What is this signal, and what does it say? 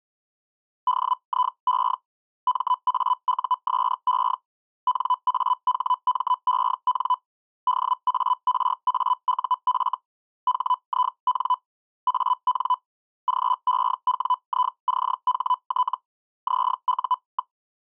Hellschreiber (Feld-Hell, 122.5 baud), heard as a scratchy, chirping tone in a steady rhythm, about 1000 Hz. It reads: DIE MAUSE NAHMEN DARAUF HIN AN GEWICHT ZU.